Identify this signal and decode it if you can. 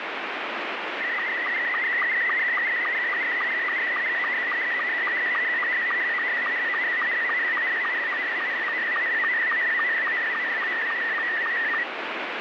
SSTV (slow-scan television), Scottie S2, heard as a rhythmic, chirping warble, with heavy radio static.